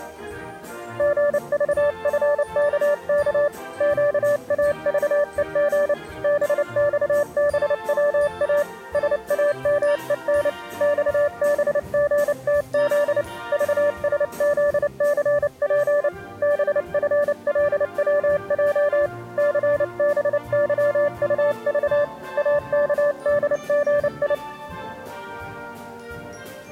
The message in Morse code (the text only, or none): GVFKK QAVEG BXBWA SAMEN XBGTZ VSZCP BFLWJ CBYUV AKDGI